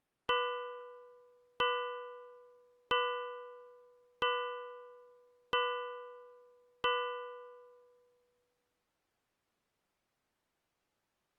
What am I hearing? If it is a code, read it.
Clock strike, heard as a bell. 6. Six o'clock.